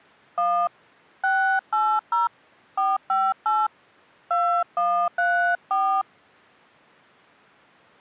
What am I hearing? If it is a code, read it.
DTMF, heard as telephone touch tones, dialled by hand, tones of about 260 ms. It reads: 1 680 458 2134